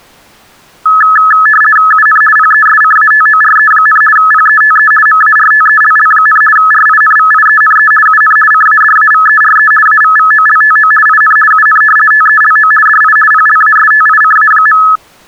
RTTY (50 baud, 450 Hz shift), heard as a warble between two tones, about 1500 Hz centre. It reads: UN PESCATORE, PETE MARTELL, RINVIENE UN CADAVERE AVVOLTO IN UN TELO DI PLASTICA.